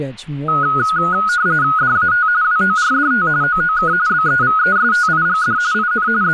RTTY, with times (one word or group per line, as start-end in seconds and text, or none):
1.8-2.3 DAT
2.4-3.3 WORDT
3.4-3.9 OOK
4.1-5.6 BEVESTIGD
5.7-6.1 IN
6.2-6.3 …